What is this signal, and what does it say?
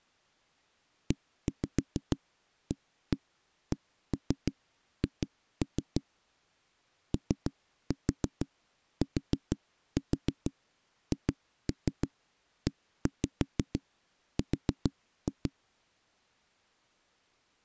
Tap code, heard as knocks on a wall, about 6 knocks a second. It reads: EACH OTHER